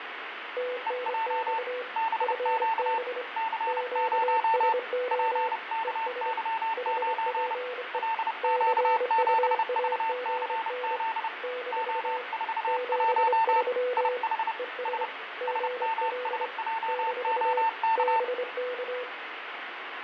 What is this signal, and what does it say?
Morse code, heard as two keyed tones, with radio static, fading and room echo. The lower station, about 25 wpm, 500 Hz: TNX FB QSO ES HPE CUAGN - 73 ES GL - BK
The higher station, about 30 wpm, 900 Hz: EJ BQ C0 PKY9 LQ7VCZ O41 IH S SMSJOK